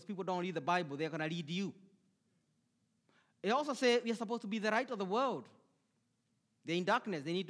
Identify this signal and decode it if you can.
Speech in English. There is no code.